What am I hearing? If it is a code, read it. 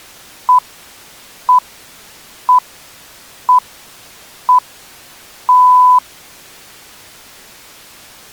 Radio time signal (six pips, as the Greenwich Time Signal), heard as pips.